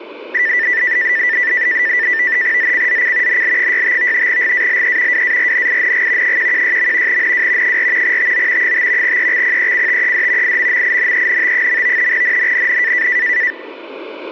NAVTEX (SITOR-B), 100 baud, 170 Hz shift, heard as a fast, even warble, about 1900 Hz centre. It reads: ZCZC NL65 GALE WARNING 116. NW 4 TO 5 EXPECTED IMMINENT. NNNN